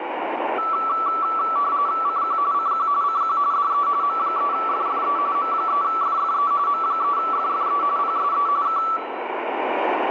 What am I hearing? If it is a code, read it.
RTTY (45.45 baud, 170 Hz shift), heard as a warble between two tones, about 1230 Hz centre, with radio static and room echo. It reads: CQ CQ CQ DE M3FFE M3FFE M3FFE PSE K